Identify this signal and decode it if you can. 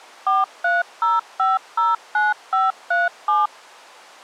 DTMF, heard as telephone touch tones, dialled by machine, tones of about 180 ms. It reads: 430509537